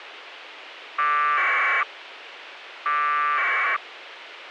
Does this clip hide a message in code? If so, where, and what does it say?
Yes: packet radio (AX.25, as in APRS), 1200 baud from 1.0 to 3.8 s, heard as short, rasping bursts, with radio hiss.